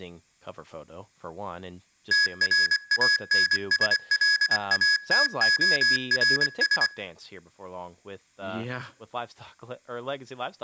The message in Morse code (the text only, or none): TRANSLATORS